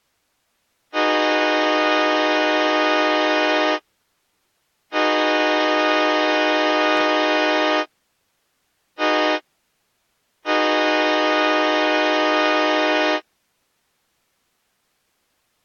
Train horn signal, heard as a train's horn. 2 long, 1 short, 1 long. On North American railways: approaching a public crossing.